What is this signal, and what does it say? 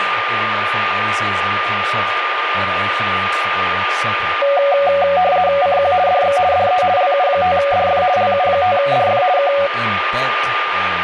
RTTY (50 baud, 170 Hz shift), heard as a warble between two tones, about 650 Hz centre, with radio static and a steady whistle near 1210 Hz. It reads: CQ DX DE LU5DF LU5DF K